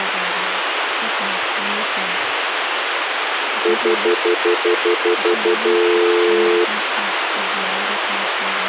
Telephone call progress tone (North American plan), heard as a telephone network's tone, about 350, 440 Hz, 0.1 s on and 0.1 s off, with phone line noise. Stutter dial tone.